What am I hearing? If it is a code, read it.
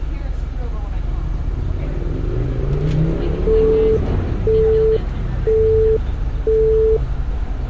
Telephone call progress tone (single-tone plan, as in Europe, Japan and elsewhere), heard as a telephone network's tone, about 440 Hz, 0.5 s on and 0.5 s off, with street noise. Busy tone.